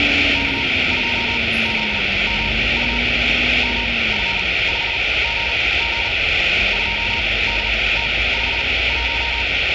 Morse code, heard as a keyed tone, machine-sent, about 39 wpm, spaced as for 22 wpm, 930 Hz, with radio static and street noise. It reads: K2ZMU MF5GG 2DT51